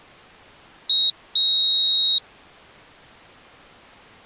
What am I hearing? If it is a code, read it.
Beep code, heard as a piezo beeper, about 3750 Hz. 1 short, 1 long.